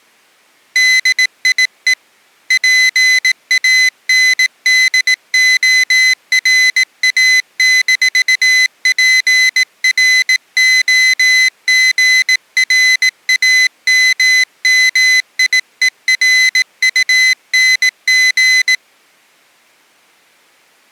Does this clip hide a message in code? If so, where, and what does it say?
Yes: Morse code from 0.7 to 18.8 s, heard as a high beeper, hand-sent with a bug key, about 18 wpm, 2050 Hz. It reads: DIE PANDORA-PROGRAMMIERUNG